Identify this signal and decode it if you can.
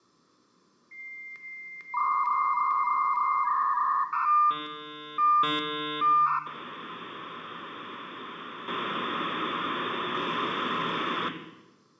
Dial-up modem handshake (V.34 or later), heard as a whistle, warbles, then hiss, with room echo.